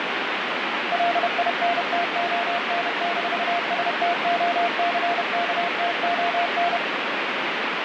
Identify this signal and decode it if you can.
Morse code, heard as a keyed tone, machine-sent, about 31 wpm, 690 Hz, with heavy radio static. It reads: LINTON-STOCKTON